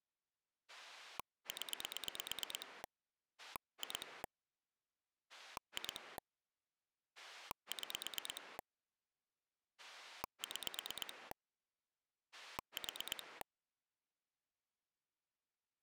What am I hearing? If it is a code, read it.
Pulse dialling, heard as a rotary dial, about 9 pulses a second. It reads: 0 2 2 6 6 4